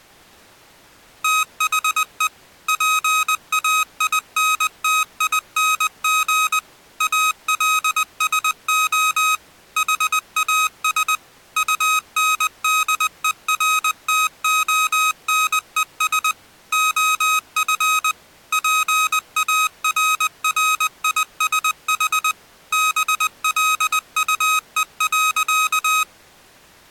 Morse code, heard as electronic beeps, machine-sent, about 20 wpm, 1260 Hz. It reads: THE PAINTING ALSO HAS UNDERTONES OF PARRISH BLUE.